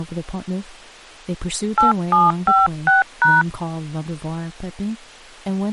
DTMF, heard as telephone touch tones, dialled by hand, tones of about 170 ms, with speech in English. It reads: 8756#